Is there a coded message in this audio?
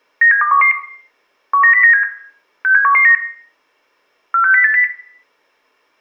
Yes: five-tone selective call (CCIR) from 0.2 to 4.8 s, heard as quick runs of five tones, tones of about 100 ms, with room echo. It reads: 97211 19097 67119 46080